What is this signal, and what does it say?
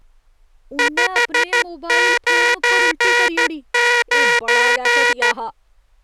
Morse code, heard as a buzzer, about 13 wpm, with speech in Dogri. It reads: 599